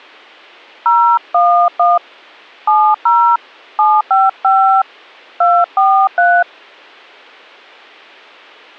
DTMF, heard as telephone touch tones, dialled by hand, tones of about 280 ms. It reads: 011 70 755 243